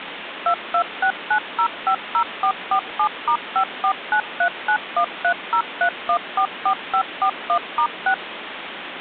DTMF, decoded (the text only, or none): 2269050447*549391303144541*6